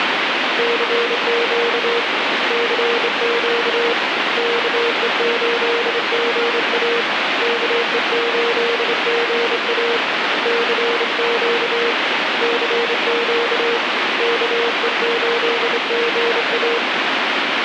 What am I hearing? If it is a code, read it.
Morse code, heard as a keyed tone, hand-sent with a straight key, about 26 wpm, 470 Hz, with heavy radio static. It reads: CQ CQ KE8GA KE8GA CQ CQ KE8GA